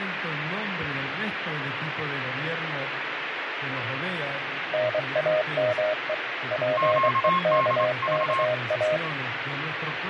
Morse code, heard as two keyed tones, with radio static. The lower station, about 23 wpm, 620 Hz: NAME PEKKA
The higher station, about 26 wpm, 1070 Hz: QDV